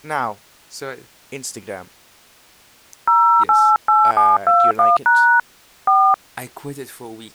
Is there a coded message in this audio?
Yes: DTMF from 3.1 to 6.1 s, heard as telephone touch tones, dialled by hand, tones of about 260 ms, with speech in English. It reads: 088721# 4